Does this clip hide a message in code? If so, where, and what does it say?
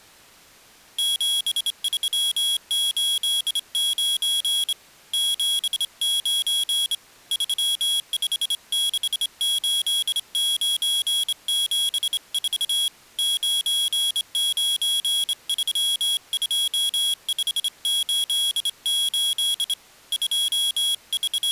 Yes: Morse code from 0.9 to 21.5 s, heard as a high beeper, hand-sent with a straight key, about 26 wpm, 3300 Hz. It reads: 7389 79 3568974 9932588 …